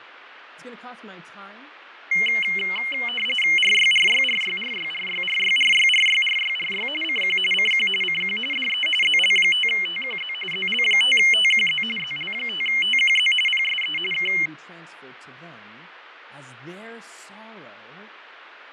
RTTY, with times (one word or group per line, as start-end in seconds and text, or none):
3.6-6.9 RYRYRYRYRYRYRYRYRYRY
7.0-7.4 CQ
7.5-7.9 CQ
8.0-8.4 CQ
8.5-8.9 DE
9.0-10.3 ZL5TQZ
10.5-11.8 ZL5TQZ
12.0-13.3 ZL5TQZ
13.5-14.0 PSE
14.1-14.3 K